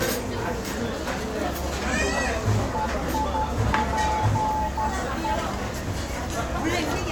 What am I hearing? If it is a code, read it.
Morse code (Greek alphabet), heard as a keyed tone, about 12 wpm, 860 Hz, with radio static, a narrow filter, room echo and the noise of a restaurant. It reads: ΕΙΠΕ